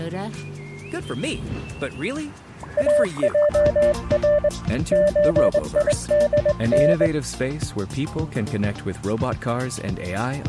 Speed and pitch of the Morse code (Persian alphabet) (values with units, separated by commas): 21 wpm, 590 Hz